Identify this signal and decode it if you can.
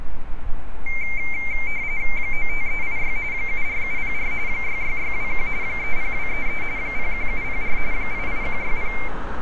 RTTY (45.45 baud, 170 Hz shift), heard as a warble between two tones, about 2200 Hz centre, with street noise. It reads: 95386 74704 66621 30233 01704 88160